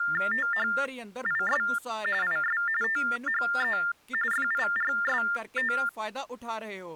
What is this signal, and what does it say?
TTY/TDD text telephone tones (45.45 baud Baudot), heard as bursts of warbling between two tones, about 400 Hz shift, 1600 Hz centre, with speech in Punjabi. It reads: THIS IS THE FIRST